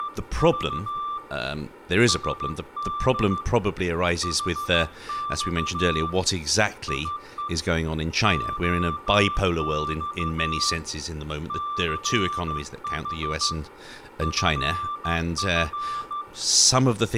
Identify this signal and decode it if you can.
Morse code, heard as a keyed tone, hand-sent with a straight key, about 14 wpm, 1180 Hz, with room echo and speech in English. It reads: … SD HX IE OX CH FF